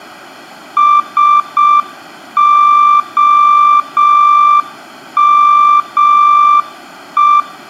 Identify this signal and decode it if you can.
Morse code, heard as a keyed tone, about 6 wpm, 1180 Hz, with room echo. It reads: SOME